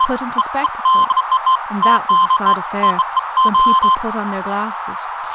Beeps of irregular length, with radio static, a narrow filter and speech in English. There is no code.